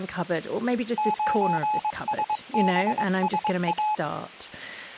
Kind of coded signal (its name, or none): Morse code